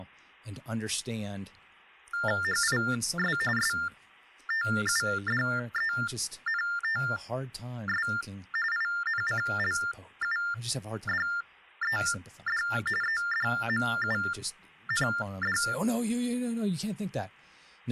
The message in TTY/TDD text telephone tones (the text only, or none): HIS STUDENTS INCLUDED EDMUND